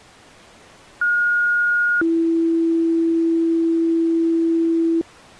Two-tone page, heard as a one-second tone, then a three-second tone, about 1430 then 330 Hz.